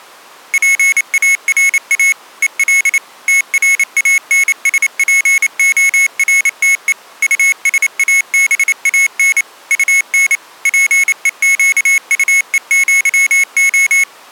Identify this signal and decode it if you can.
Morse code (with Spanish letters), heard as a high beeper, machine-sent, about 28 wpm, 2200 Hz. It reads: PARA EL TRANSPORTE USABAN UN PEQUEÑO